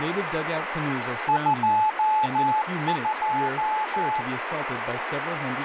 Morse code, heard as a keyed tone, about 14 wpm, 860 Hz, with heavy radio static and speech in English. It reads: 22